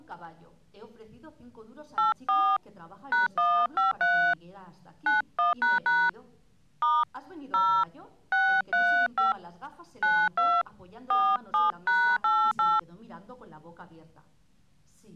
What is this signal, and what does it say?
DTMF, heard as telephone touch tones, dialled by hand, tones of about 240 ms. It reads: 84 #153 91## * 0 635 92 47#88